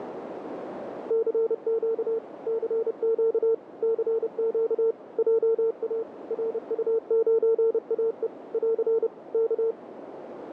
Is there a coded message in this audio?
Yes: Morse code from 1.0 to 9.8 s, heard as a keyed tone, machine-sent, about 30 wpm, 450 Hz, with radio static and a narrow filter. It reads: CQ CQ CQ JA RU9AE <AR> K